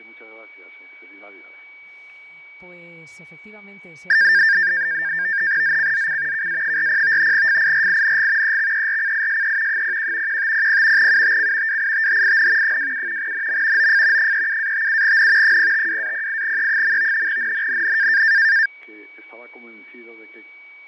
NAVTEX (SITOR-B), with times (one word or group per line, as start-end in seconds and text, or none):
5.6-6.5 ZCZC
6.3-7.3 KA40
7.3-8.6 FIRING
8.4-9.8 EXERCISE
9.7-10.4 01
10.3-11.1 1500
11.0-11.8 UTC
11.7-12.8 WITHIN
12.6-13.3 27
13.2-13.9 NM
13.8-14.3 OF
14.2-15.6 37-57N
15.4-17.3 052-08E.
17.3-18.2 NNNN